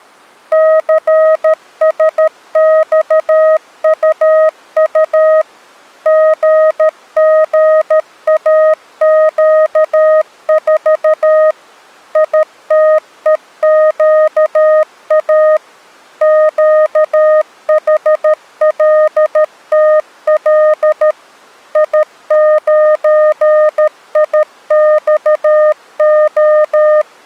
Morse code, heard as a keyed tone, machine-sent, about 13 wpm, 620 Hz. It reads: CSXUU GGAQ4 ITEQA QHLTL I9IXO